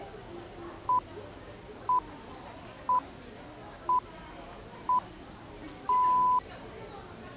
Radio time signal (six pips, as the Greenwich Time Signal), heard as pips, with the noise of a crowd indoors.